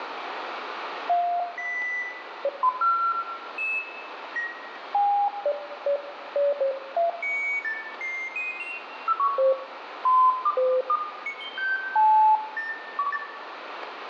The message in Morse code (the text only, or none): none